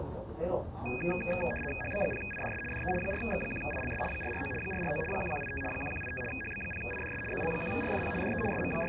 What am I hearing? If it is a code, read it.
RTTY (75 baud, 850 Hz shift), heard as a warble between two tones, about 2050 Hz centre, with the noise of a crowd indoors. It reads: HB0IDS DE 4X1ILS 449 449 1185 1185 HB0IDS ZL1RFP DE …